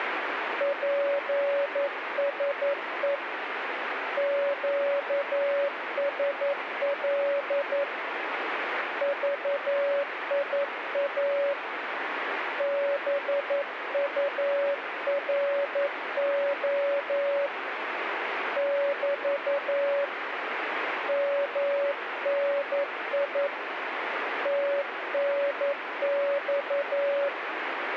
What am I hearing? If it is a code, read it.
Morse code, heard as a keyed tone, hand-sent with a paddle, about 11 wpm, 560 Hz, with radio static. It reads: PSE QSL VIA BURO <BT> MNI TNX